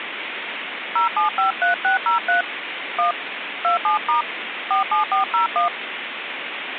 DTMF, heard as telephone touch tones, dialled by hand, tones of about 120 ms, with phone line noise. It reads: 0753603 1 27* 47401